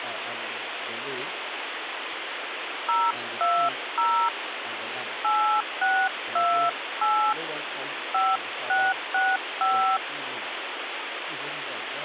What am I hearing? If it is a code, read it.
DTMF, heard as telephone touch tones, dialled by hand, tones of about 270 ms, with phone line noise. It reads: 020 8628 5665